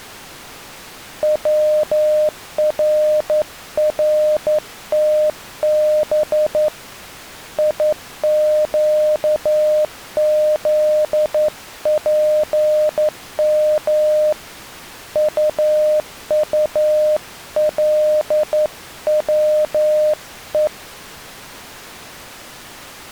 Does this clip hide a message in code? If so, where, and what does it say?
Yes: Morse code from 1.2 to 20.7 s, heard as a keyed tone, hand-sent with a straight key, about 11 wpm, 610 Hz. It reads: WRRTB IQZPM UULWE